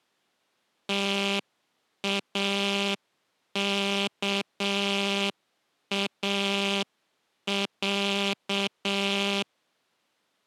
Morse code (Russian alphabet), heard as a buzzer, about 7 wpm. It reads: ТАКАЯ